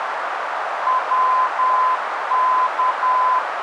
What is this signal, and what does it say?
Morse code, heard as a keyed tone, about 10 wpm, 1020 Hz, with radio static and a narrow filter. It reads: WK